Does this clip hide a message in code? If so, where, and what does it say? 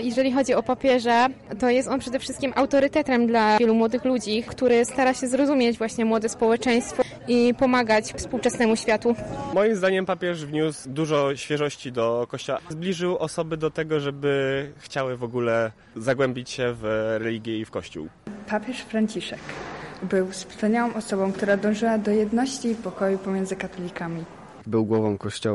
No.